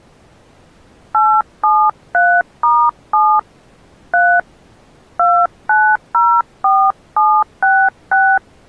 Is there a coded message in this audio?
Yes: DTMF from 1.1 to 8.4 s, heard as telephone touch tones, dialled by hand, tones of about 260 ms. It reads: 873*7 3 2904766